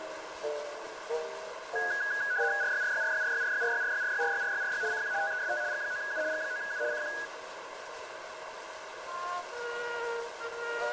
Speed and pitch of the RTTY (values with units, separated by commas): 75 baud, 170 Hz shift, 1550 Hz centre